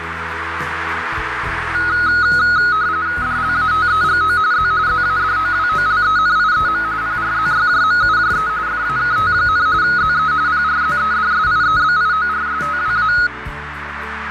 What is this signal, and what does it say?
RTTY (45.45 baud, 170 Hz shift), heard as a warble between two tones, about 1360 Hz centre, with radio static and a narrow filter. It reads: DLATEGO Z ZADOWOLENIEM PRZYJMUJE FAKT, ZE PRZEDSIEBIORSTWA